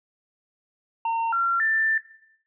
Telephone call progress tone (North American plan), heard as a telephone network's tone, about 910, 1370, 1800 Hz. Special information tone.